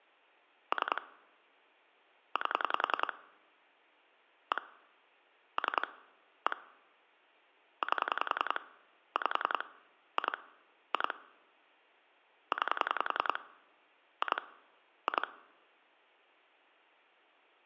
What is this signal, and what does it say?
Pulse dialling, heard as clicks on a phone line, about 10 pulses a second. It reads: 3 8 1 3 1 8 5 2 2 9 2 2